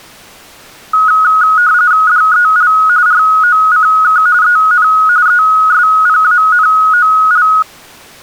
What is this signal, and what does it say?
RTTY (45.45 baud, 170 Hz shift), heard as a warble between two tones, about 1360 Hz centre. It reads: DEL ROCK EN ESPANOL